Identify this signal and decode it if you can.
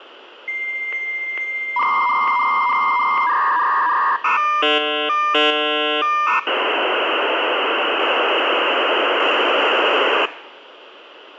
Dial-up modem handshake (V.34 or later), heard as a whistle, warbles, then hiss, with phone line noise.